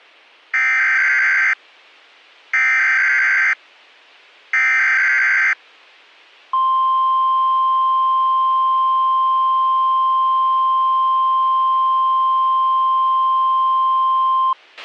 Emergency Alert System (SAME) tones (header bursts, then the 1050 Hz attention tone), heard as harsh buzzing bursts, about 520.83 baud, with a squelch burst at the end.